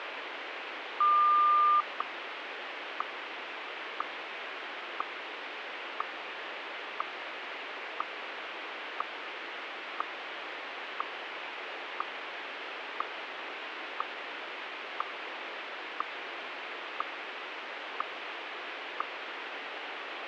Radio time signal (WWVH, Hawaii), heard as ticks, one a second, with radio static.